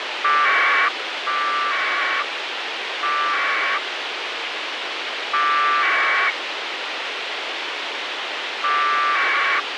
Packet radio (AX.25, as in APRS), 1200 baud, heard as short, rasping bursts, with radio hiss.